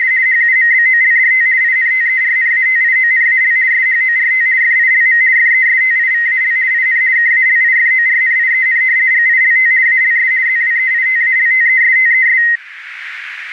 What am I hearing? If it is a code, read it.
RTTY (50 baud, 170 Hz shift), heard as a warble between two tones, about 1950 Hz centre, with radio static. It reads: … HUMBOLDT INTERNATIONAL SHORT FILM FESTIVAL IN KALIFORNIEN GILT ALS ZWEITALTESTES